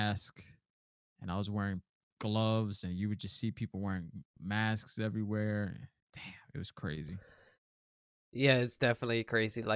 Speech in English. There is no code.